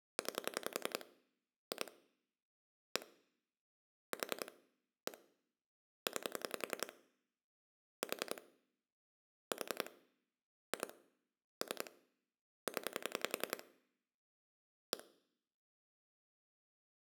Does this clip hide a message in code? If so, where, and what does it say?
Yes: pulse dialling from 0.2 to 15.0 s, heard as clicks on a phone line, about 10 pulses a second. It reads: 9 2 1 4 1 9 4 4 2 3 0 1